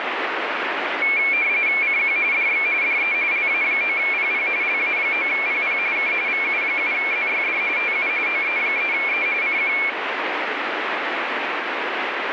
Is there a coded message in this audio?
Yes: RTTY (45.45 baud, 170 Hz shift) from 1.0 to 9.9 s, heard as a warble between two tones, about 2300 Hz centre, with radio static. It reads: CQ DX DE LA9PP LA9PP K VU7ZYD TU OE3E CQ